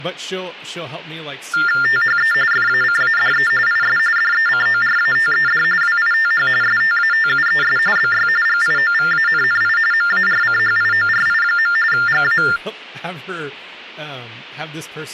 TTY/TDD text telephone tones (45.45 baud Baudot), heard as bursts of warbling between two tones, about 400 Hz shift, 1600 Hz centre, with speech in English. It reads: THE FACADE IS DECORATED WITH STATUES BY GIOVANNI MARCHIORI. GA